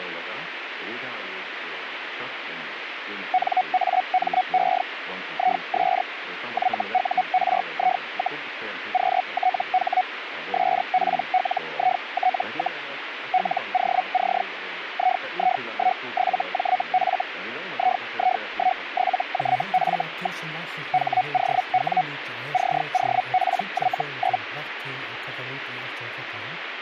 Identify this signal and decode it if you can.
Hellschreiber (Feld-Hell, 122.5 baud), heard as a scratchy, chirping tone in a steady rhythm, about 740 Hz, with radio static. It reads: NAME IS YURI, QTH SPLIT, LOC II17JF II17JF. HOW COPY?